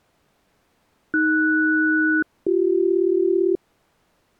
Aircraft SELCAL, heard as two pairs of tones. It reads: AS-BC